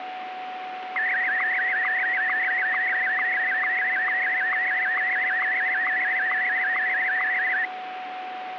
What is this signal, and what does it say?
SSTV (slow-scan television), Martin M1, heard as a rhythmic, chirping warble, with radio static and a steady whistle near 740 Hz.